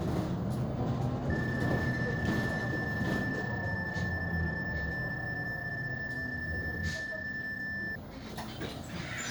PSK31 (31.25 baud), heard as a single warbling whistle, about 1750 Hz, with the noise inside a bus.